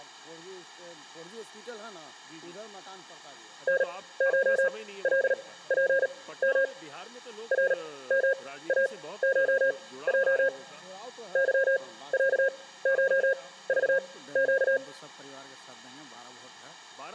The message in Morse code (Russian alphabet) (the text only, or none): НШЛПМ РМАШЙ ЫЯШЖЩ